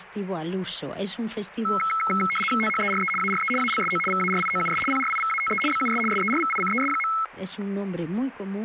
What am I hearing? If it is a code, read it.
RTTY (75 baud, 850 Hz shift), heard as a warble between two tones, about 1750 Hz centre. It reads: THERE ARE ALSO VARIOUS PRIVATE BUS SERVICES.